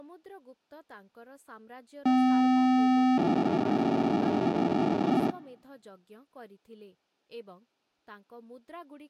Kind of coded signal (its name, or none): POCSAG pager data